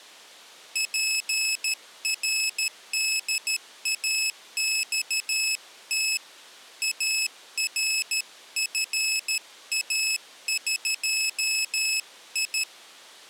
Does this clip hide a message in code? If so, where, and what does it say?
Yes: Morse code (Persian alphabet) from 0.7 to 12.7 s, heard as a high beeper, hand-sent with a paddle, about 13 wpm, 2600 Hz. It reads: پرداخت ارفاقی